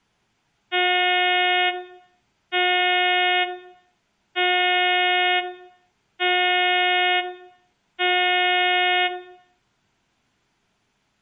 Ship horn signal, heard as a ship's horn, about 360 Hz, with room echo. 5 short. At sea: I doubt that you are doing enough to avoid a collision.